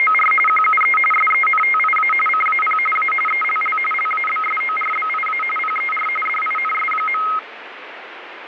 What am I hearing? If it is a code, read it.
RTTY (45.45 baud, 850 Hz shift), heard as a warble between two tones, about 1700 Hz centre, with radio static. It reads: … QUE SENTIA CAP A ELL LABSORBIA PER DINS.